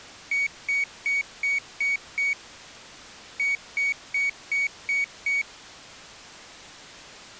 Beep code, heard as a piezo beeper, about 2250 Hz. 6-6.